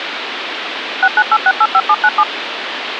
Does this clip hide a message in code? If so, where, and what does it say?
Yes: DTMF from 1.0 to 2.2 s, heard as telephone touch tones, dialled by machine, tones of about 60 ms, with phone line noise. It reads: 698685797